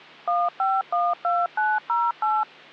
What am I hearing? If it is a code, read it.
DTMF, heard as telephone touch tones, dialled by machine, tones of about 210 ms. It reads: 1512908